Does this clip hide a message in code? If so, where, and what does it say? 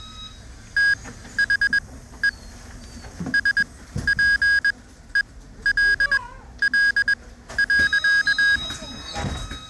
Yes: Morse code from 0.7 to 8.6 s, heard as electronic beeps, machine-sent, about 21 wpm, spaced as for 13 wpm, 1650 Hz, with the noise inside a bus. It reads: THE SPELL.